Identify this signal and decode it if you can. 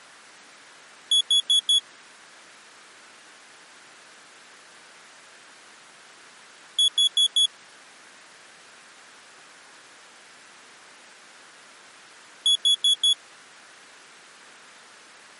Alarm pattern, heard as an alarm's beeps, played three times, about 3400 Hz. Temporal four. Carbon monoxide.